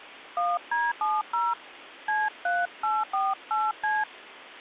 DTMF, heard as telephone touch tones, dialled by hand, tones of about 200 ms. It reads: 1D70 C3848C